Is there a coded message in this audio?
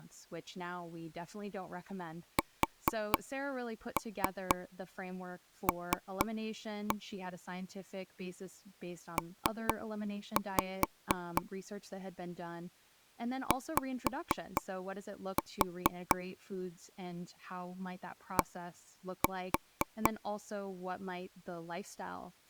Yes: tap code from 2.4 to 20.1 s, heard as taps on a table, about 4 knocks a second, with speech in English. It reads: SL P Y D